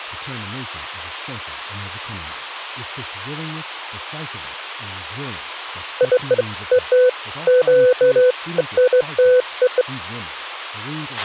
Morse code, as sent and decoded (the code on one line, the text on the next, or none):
none